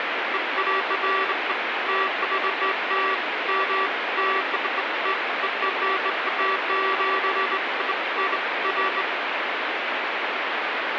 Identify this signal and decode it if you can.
Beeps of irregular length, with radio static. There is no code.